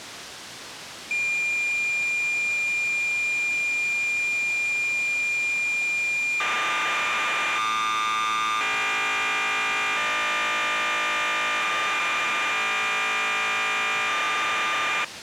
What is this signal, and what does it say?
Cassette data (Kansas City type), 1200 baud, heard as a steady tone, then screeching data, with tape hiss.